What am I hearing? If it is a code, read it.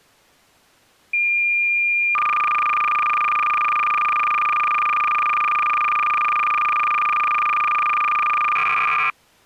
Cassette data (Kansas City type), 300 baud, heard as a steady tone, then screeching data.